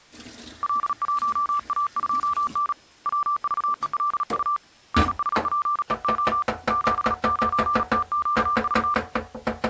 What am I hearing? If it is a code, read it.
Morse code, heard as a keyed tone, hand-sent with a paddle, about 37 wpm, 1180 Hz, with kitchen noise. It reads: L1A2N WVELU NSPEO 79TQV